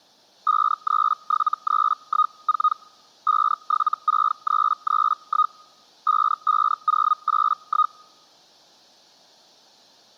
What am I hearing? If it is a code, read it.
Hellschreiber (Feld-Hell, 122.5 baud), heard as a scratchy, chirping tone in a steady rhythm, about 1240 Hz. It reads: 537314 576331 55081